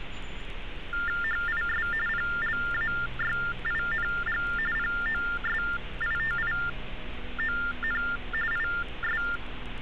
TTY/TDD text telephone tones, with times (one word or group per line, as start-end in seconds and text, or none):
1.2-1.9 HIS
2.1-4.4 PLAYING
4.8-8.0 POSITION
8.5-9.2 IS